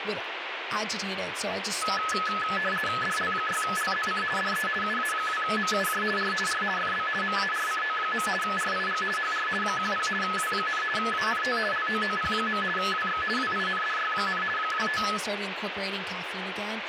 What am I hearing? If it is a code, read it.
RTTY (50 baud, 450 Hz shift), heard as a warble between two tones, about 1500 Hz centre, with radio static and speech in English. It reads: DL6LZC DE UA2MUJ R R FB MARCO. RIG HR 10 W, ANT LOOP. WX WINDY, 25